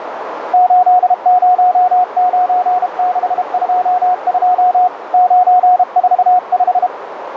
Morse code, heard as a keyed tone, hand-sent with a paddle, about 32 wpm, 730 Hz, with radio static and a narrow filter. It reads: 809622 945